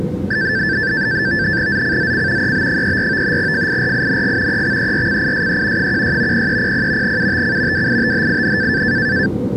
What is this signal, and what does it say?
NAVTEX (SITOR-B), 100 baud, 170 Hz shift, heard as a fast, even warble, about 1650 Hz centre, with the noise inside a subway train. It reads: ZCZC EB34 FIRING EXERCISE 16 0300 UTC WITHIN